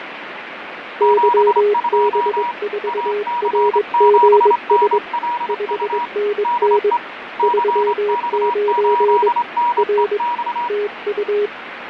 Morse code, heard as two keyed tones, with radio static and fading. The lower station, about 22 wpm, 410 Hz: YB4RGS 5NN 39 R TU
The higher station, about 25 wpm, 960 Hz: 72 AC7NLU DE CX8NEX